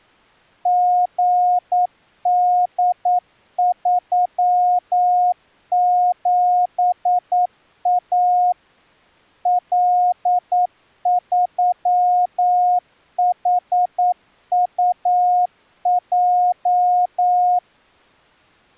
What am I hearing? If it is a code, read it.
Morse code, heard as a keyed tone, machine-sent, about 9 wpm, 720 Hz. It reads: GD37A L3HUJ